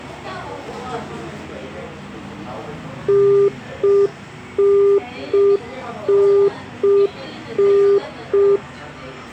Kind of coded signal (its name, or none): telephone call progress tone